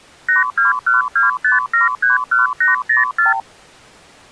Multi-frequency trunk signalling (R2, with the far end's replies), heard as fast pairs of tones, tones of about 140 ms. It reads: 82125731804